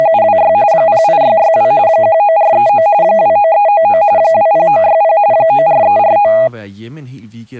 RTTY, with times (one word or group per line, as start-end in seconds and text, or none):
0.0-0.5 …
0.7-1.7 08662
1.9-2.9 19439
3.0-4.0 29399
4.2-5.2 20960
5.3-6.3 94349